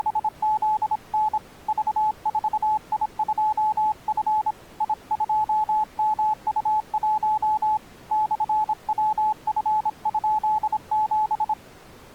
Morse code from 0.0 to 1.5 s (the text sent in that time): …